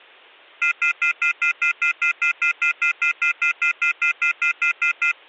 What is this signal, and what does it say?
Telephone call progress tone (North American plan), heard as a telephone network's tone, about 1400, 2050, 2450, 2600 Hz, 0.1 s on and 0.1 s off. Off-hook warning tone.